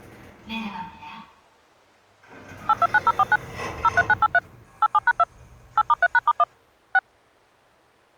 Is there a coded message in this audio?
Yes: DTMF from 2.7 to 7.0 s, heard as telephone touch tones, dialled by machine, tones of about 40 ms, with the noise inside a lift. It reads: 829049 03983 87#2 8*3#*1 6